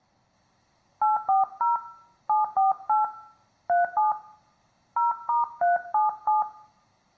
DTMF, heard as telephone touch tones, dialled by hand, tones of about 150 ms, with room echo. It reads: 840 748 37 0*377